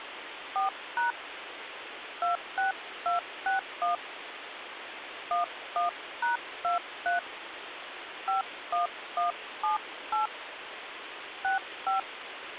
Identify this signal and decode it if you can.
DTMF, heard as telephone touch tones, dialled by hand, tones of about 130 ms, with phone line noise. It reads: 4# 26261 11#23 51178 65